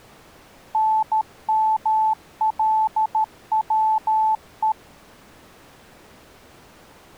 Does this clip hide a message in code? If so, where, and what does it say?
Yes: Morse code (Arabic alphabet) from 0.7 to 4.8 s, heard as a keyed tone, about 13 wpm, 870 Hz. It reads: نملوء